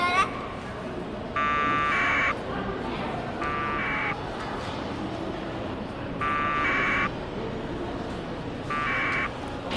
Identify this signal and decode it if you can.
Packet radio (AX.25, as in APRS), 1200 baud, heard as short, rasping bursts, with a squelch burst at the end and the noise of a crowd indoors.